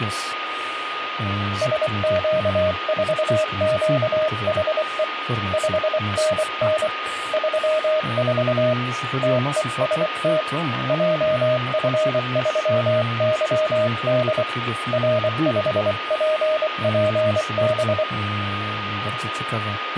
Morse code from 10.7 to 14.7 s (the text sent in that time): JF3YD